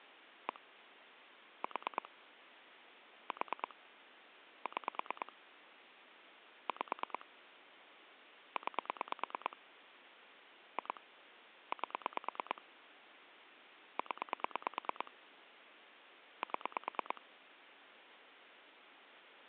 Pulse dialling, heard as clicks on a phone line, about 9 pulses a second. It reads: 1 4 4 6 5 9 2 8 0 7